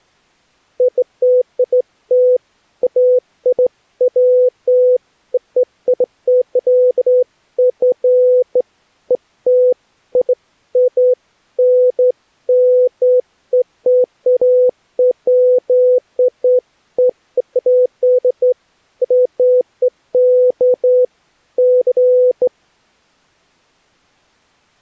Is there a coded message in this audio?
No, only beeps of irregular length.